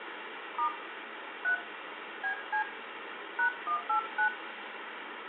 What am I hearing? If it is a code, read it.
DTMF, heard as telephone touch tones, dialled by hand, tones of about 100 ms, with phone line noise and room echo. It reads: * 3 BC #189